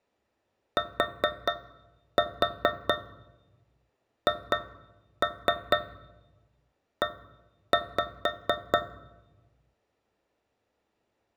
Tap code, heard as taps on a metal pipe, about 4 knocks a second, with room echo. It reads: THE